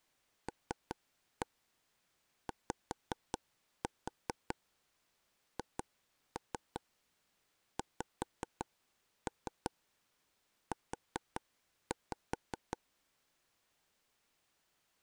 Tap code, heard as taps on a table, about 5 knocks a second. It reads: LYHXU